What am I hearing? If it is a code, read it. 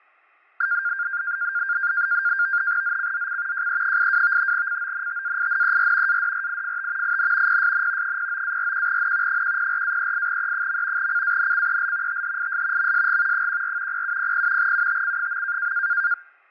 NAVTEX (SITOR-B), 100 baud, 170 Hz shift, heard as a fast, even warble, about 1500 Hz centre, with fading. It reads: ZCZC JE82 CONTAINER ADRIFT IN PSN 09-41N 104-38E. CANCEL THIS MSG 14 0700 UTC.